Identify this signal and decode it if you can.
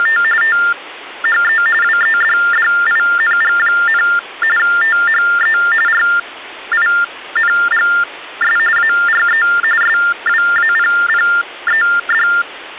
TTY/TDD text telephone tones (45.45 baud Baudot), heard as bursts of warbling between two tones, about 400 Hz shift, 1600 Hz centre. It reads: … THE WEDDING, THE RINGS ARE SWAPPED